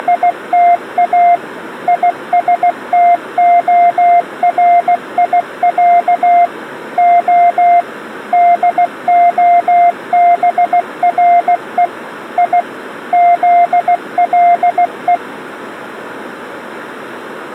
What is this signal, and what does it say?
Morse code (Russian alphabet), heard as a keyed tone, machine-sent, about 16 wpm, 700 Hz. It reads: … ИСТОРИЯ О ДОБРЕ И ЗЛЕ